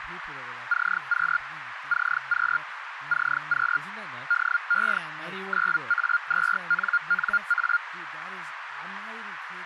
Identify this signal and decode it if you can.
Hellschreiber (Feld-Hell, 122.5 baud), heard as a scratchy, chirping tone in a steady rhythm, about 1410 Hz, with radio static, a narrow filter and speech in English. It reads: CQ CQ CQ DE 9A2NNA